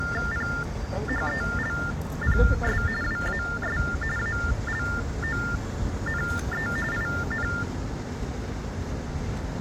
TTY/TDD text telephone tones (45.45 baud Baudot), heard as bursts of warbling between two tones, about 400 Hz shift, 1600 Hz centre, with street noise. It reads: PHELPS WAS ALONE IN